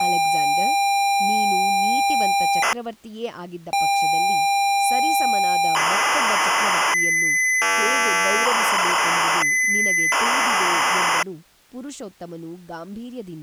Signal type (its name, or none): ZX Spectrum tape loading